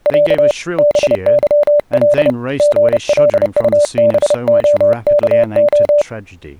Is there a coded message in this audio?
Yes: Morse code (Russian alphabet) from 0.0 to 6.1 s, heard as a keyed tone, hand-sent with a paddle, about 30 wpm, 590 Hz, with speech in English. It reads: Я БЫЛ ГЛУБОКО